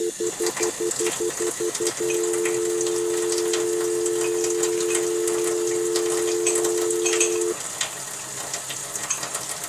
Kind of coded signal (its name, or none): telephone call progress tone